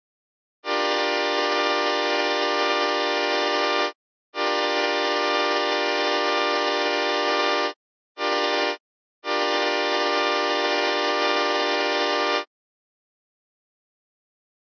Train horn signal, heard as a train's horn. 2 long, 1 short, 1 long. On North American railways: approaching a public crossing.